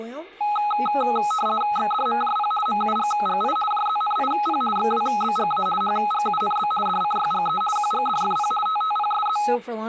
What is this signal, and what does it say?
RTTY (50 baud, 450 Hz shift), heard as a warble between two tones, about 1060 Hz centre, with speech in English. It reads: XDMJP MUGGI JZNIP XWBGA HGUNB DCYGE QGDFP TTPSZ